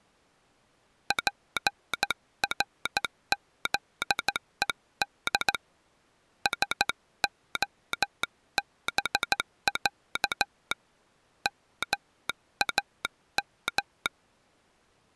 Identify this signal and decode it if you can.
Morse code (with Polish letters), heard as a telegraph sounder, hand-sent with a straight key, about 14 wpm. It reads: PRZED SOBĄ MAM